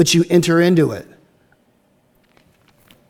Speech in English. There is no code.